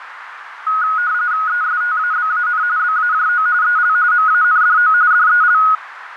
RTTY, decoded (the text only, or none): ESTABAN BAJO EL MANDO DEL